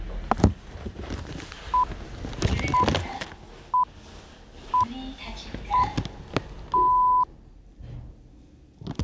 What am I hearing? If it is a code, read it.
Radio time signal (six pips, as the Greenwich Time Signal), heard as pips, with the noise inside a lift.